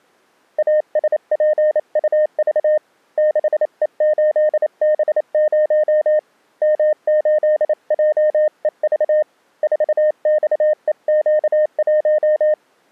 Morse code, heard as a keyed tone, hand-sent with a paddle, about 28 wpm, 610 Hz. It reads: ASPUV 6E8B0 M8JEV 4XEQ1